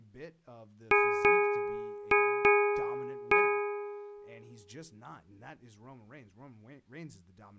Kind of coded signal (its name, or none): ship's bell